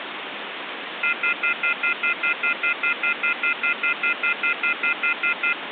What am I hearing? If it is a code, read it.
Telephone call progress tone (North American plan), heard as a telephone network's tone, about 1400, 2050, 2450, 2600 Hz, 0.1 s on and 0.1 s off, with phone line noise. Off-hook warning tone.